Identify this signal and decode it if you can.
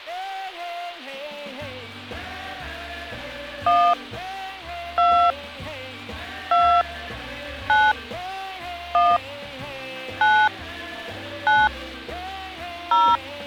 DTMF, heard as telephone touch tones, dialled by hand, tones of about 270 ms. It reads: 1 2 2 9 1 9 9 0